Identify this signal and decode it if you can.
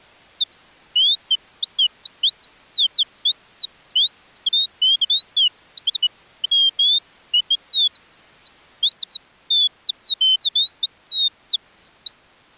Bird-like chirps. There is no code.